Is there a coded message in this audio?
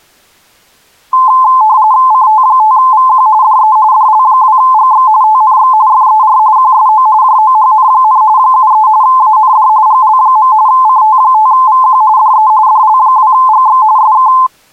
Yes: RTTY (45.45 baud, 170 Hz shift) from 1.1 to 14.5 s, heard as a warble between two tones, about 950 Hz centre. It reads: CT5VQ DE DL2GX TNX FER QSO JOHN, 73 AND GL. CT5VQ DE DL2GX SK